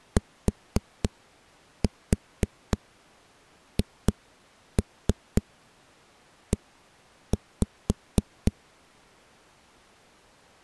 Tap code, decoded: THE

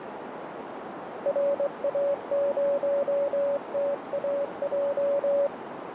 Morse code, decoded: RA0TAJ

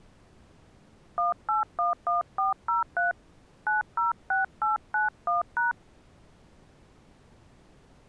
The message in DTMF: 1811403 906891#

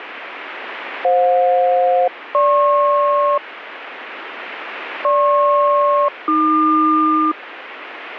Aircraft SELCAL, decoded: FJ-GP GP-AQ

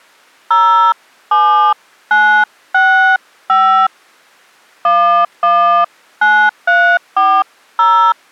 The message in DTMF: 07965 119340

